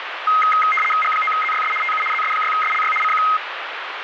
RTTY (75 baud, 850 Hz shift), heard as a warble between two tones, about 1700 Hz centre, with radio static. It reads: G9ZYS TU ZS6SLY CQ